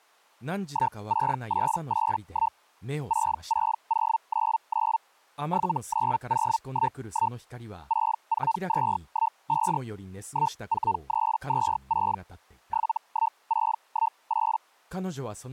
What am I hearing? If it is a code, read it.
Hellschreiber (Feld-Hell, 122.5 baud), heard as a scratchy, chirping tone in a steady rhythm, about 900 Hz, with speech in Japanese. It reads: 16881 66099 79011 64215 14326 71618